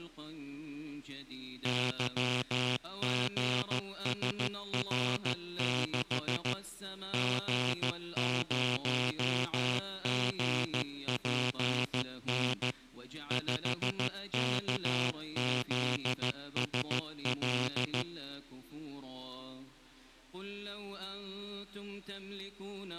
Morse code, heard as a buzzer, machine-sent, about 14 wpm. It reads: YGSR6 G0GPN 5KZSL